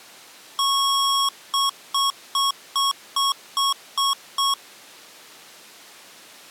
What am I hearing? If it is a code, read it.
Beep code, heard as beeps from a small speaker, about 1100 Hz. 1 long, 8 short. In AMI BIOS tables: display or retrace test failure.